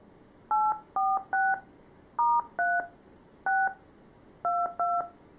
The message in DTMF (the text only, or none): 846 *3 6 22